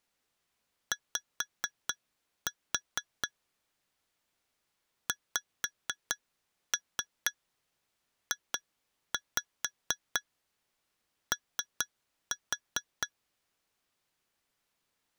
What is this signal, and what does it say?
Tap code, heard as taps on glass, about 4 knocks a second. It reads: Y XJO